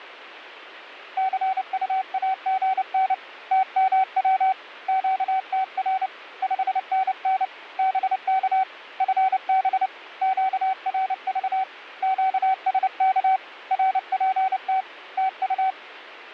Morse code, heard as a keyed tone, hand-sent with a paddle, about 29 wpm, 760 Hz. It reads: CUAGN TMW QTR 5NN BK FB QRV QSK RPT TU